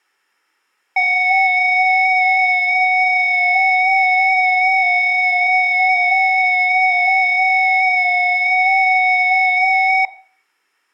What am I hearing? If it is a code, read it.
FT8 (several signals at once), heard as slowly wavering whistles, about 6.25 baud, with room echo.